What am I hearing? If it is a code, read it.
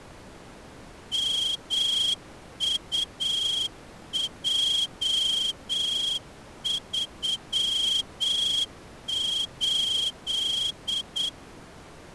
Morse code, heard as a whistle, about 8 wpm. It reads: MUJ38